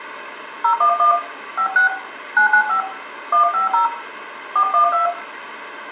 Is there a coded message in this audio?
Yes: DTMF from 0.6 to 5.1 s, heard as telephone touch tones, dialled by hand, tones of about 120 ms, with room echo. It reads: 011 56 995 150 412